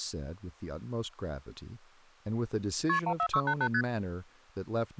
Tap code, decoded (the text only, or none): none